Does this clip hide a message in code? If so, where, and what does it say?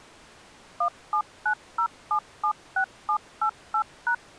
Yes: DTMF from 0.8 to 4.1 s, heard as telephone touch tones, dialled by machine, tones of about 80 ms. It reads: 1790776788#